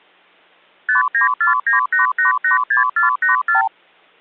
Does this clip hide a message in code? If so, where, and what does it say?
Yes: multi-frequency trunk signalling (R2, with the far end's replies) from 0.9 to 3.7 s, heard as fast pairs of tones, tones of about 130 ms. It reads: 59498886484